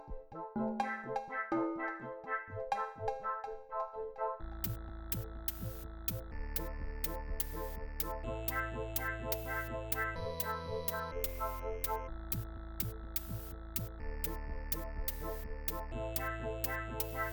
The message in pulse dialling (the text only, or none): none